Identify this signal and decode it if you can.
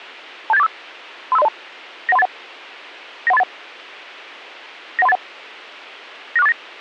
Five-tone selective call (EIA), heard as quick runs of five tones, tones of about 30 ms. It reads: 27845 35302 91381 91381 91381 96489